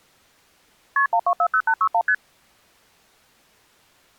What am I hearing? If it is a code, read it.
Multi-frequency trunk signalling (R1, as on North American trunks), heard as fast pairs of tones, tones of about 70 ms. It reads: KP 1240861 ST